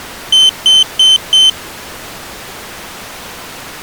Beep code, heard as a piezo beeper, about 3100 Hz. 4 short. In AMI BIOS tables: system timer failure; in Dell tables: memory read or write failure.